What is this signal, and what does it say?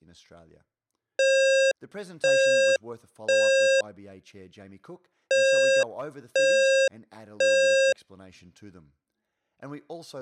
Alarm pattern, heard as an alarm's beeps, played twice, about 540 Hz, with speech in English. Temporal three. Smoke or fire, evacuate.